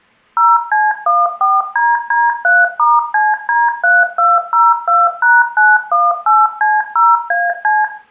DTMF, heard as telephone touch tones, dialled by machine, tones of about 200 ms, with room echo. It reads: 0C14DD3*CD3202#918C0AC